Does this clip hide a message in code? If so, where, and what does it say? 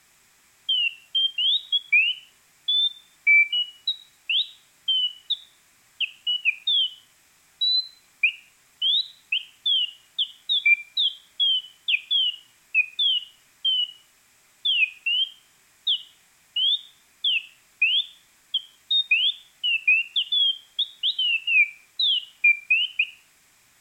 No, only bird-like chirps.